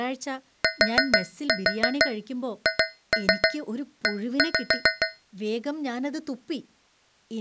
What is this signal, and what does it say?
Tap code, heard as taps on a metal pipe, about 7 knocks a second, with speech in Malayalam. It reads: THE